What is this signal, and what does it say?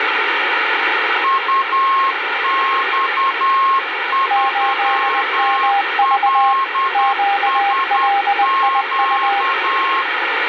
Morse code, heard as two keyed tones, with radio static. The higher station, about 10 wpm, 1080 Hz: UX3LSQ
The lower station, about 20 wpm, 800 Hz: 8MV QLIU